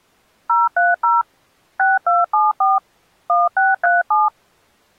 DTMF, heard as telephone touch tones, dialled by machine, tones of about 180 ms. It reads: 030 6274 1637